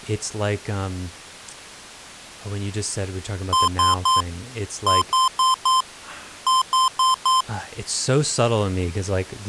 Beep code, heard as beeps from a small speaker, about 1040 Hz, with speech in English. 3-4-4.